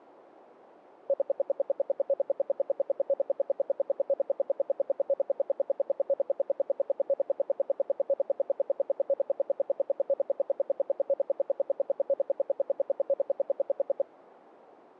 Radio time signal (RWM, Moscow), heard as ten pulses a second.